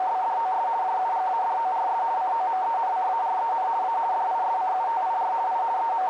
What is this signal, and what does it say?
RTTY (50 baud, 170 Hz shift), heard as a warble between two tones, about 830 Hz centre, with radio static and a narrow filter. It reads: … JUGADORS COMENCAREN A DISCUTIR I …